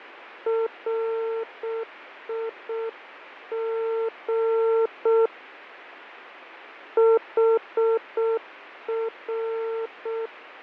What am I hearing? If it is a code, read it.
Morse code, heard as a keyed tone, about 6 wpm, 450 Hz, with radio static and fading. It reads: RIG HR